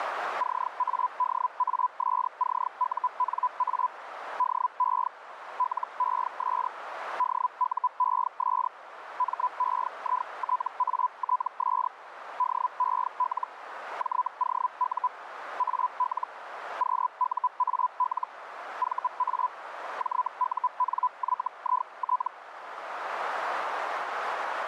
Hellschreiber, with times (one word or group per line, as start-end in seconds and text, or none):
0.4-3.9 CADASCUNA
4.4-5.1 DE
5.6-6.7 LES
7.2-8.7 DUES
9.2-11.9 MEITATS
12.4-13.5 DEL
14.0-15.1 JOU
15.6-16.3 AL
16.8-18.3 QUAL
18.8-19.5 VA
20.0-22.3 JUNYIT